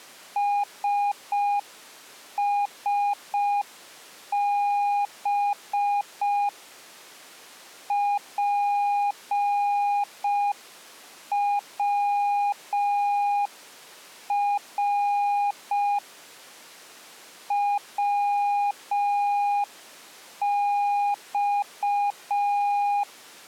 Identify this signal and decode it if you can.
Morse code, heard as a keyed tone, hand-sent with a paddle, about 5 wpm, 820 Hz. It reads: SSB PWR WX